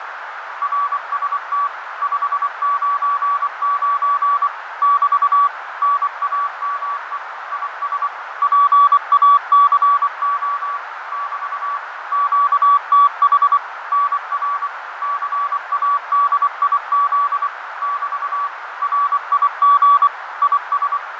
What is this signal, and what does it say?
Morse code, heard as a keyed tone, machine-sent, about 24 wpm, 1140 Hz, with radio static, fading and a narrow filter. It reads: RST 599 <BT> NAME IS PACO <BT> QTH NR CADIZ <BT> RIG IS